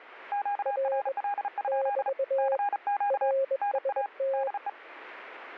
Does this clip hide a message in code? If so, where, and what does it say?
Yes: Morse code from 0.3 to 4.8 s, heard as two keyed tones. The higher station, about 34 wpm, 810 Hz: QRL? CQ NA DE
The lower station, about 21 wpm, 540 Hz: R <BT> RST